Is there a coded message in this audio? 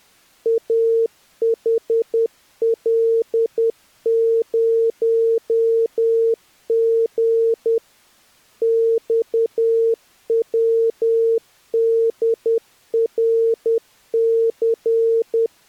Yes: Morse code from 0.4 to 15.5 s, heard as a keyed tone, machine-sent, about 10 wpm, 460 Hz. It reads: AHL0G XWDRC